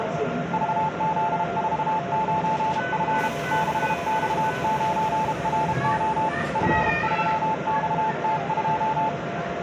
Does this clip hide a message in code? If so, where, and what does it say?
Yes: Morse code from 0.5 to 9.2 s, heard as a keyed tone, hand-sent with a paddle, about 32 wpm, 880 Hz, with the noise inside a subway train. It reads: VZ49F 6X9RO F3XT2